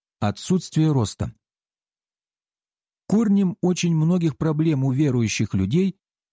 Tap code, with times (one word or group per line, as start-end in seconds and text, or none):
none